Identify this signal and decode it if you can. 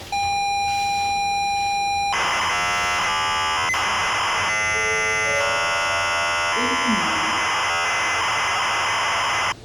ZX Spectrum tape loading, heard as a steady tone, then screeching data, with the noise inside a lift.